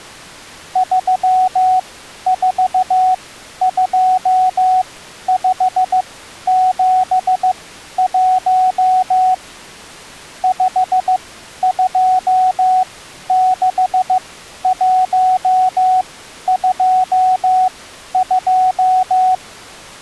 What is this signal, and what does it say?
Morse code, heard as a keyed tone, machine-sent, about 15 wpm, spaced as for 11 wpm, 740 Hz. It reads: 342571 526122